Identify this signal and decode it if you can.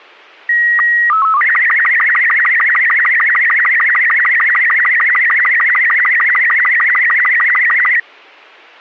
SSTV (slow-scan television), Robot 36, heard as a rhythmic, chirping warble.